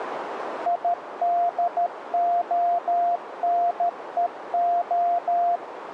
Morse code, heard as a keyed tone, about 13 wpm, 700 Hz, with radio static and a narrow filter. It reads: IDONEO